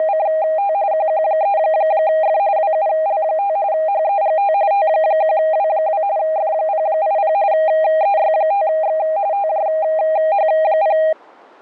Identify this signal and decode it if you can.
RTTY (45.45 baud, 170 Hz shift), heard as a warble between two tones, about 720 Hz centre. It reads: … QQ3F WUL5 HEGT T1W2 F080 EY5X TJH0